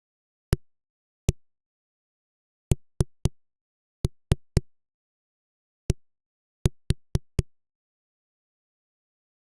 Tap code, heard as knocks on a wall, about 4 knocks a second. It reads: AND